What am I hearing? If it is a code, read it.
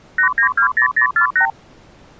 Multi-frequency trunk signalling (R2, with the far end's replies), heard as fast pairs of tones, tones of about 100 ms. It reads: 8920048